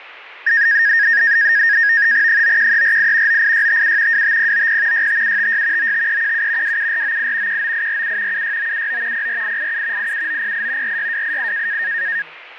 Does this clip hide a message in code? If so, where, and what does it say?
Yes: NAVTEX (SITOR-B), 100 baud, 170 Hz shift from 0.5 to 12.2 s, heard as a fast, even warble, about 1750 Hz centre, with radio static, fading and speech in Punjabi. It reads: 91348 98657 25090 65756 95317 27498 19847 76979 04887 87908 46288